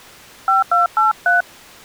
DTMF, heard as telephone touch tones, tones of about 150 ms. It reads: 5283